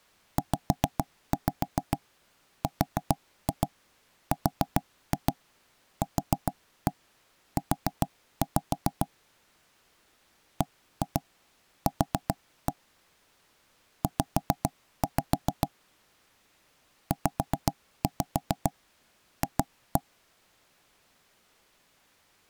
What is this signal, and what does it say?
Tap code, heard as knocks on wood, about 7 knocks a second. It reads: ZRRQU BQ Z ZF